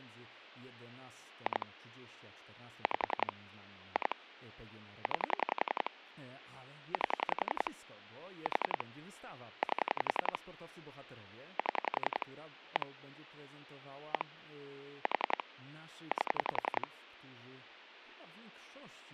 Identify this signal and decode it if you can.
Pulse dialling, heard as clicks on a phone line, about 11 pulses a second, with phone line noise and speech in Polish. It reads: 2 5 2 9 8 4 8 7 1 1 4 8